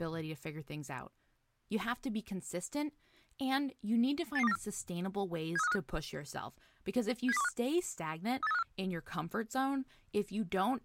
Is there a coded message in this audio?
Yes: five-tone selective call (EEA) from 4.4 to 8.6 s, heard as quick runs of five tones, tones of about 40 ms, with speech in English. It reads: 88294 73535 70215 38354